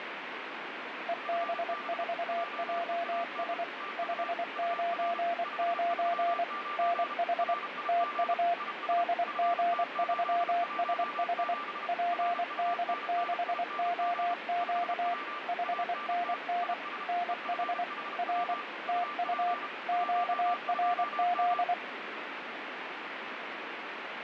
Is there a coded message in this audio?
Yes: Morse code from 1.0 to 21.8 s, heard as two keyed tones, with radio static. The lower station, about 24 wpm, 700 Hz: EB4JS 599 NH TU DG3SH PD6OQ 5NN NH R TU QRZ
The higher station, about 32 wpm, 1180 Hz: FB JEAN TU UR 539 RIG IS FT817 RUNNING 5W ANT IS EFHW UP 12M